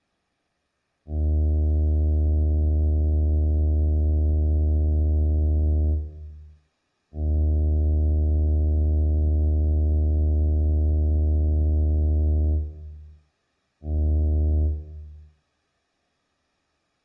Ship horn signal, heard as a ship's horn, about 80 Hz, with room echo. 2 long, 1 short. At sea: I intend to overtake on your starboard side.